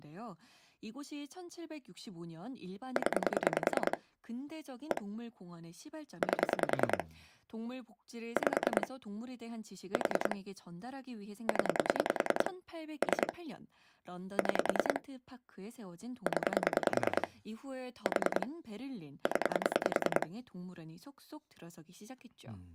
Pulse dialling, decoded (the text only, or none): 0 1 8 5 4 0 3 6 0 4 0